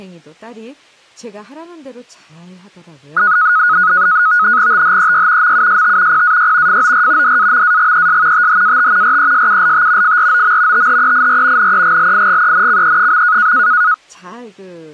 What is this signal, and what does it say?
NAVTEX (SITOR-B), 100 baud, 170 Hz shift, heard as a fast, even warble, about 1360 Hz centre, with speech in Korean. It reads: THEY MUST PAY FOR DAMAGES THAT RESULT FROM THEIR NEGLIGENCE.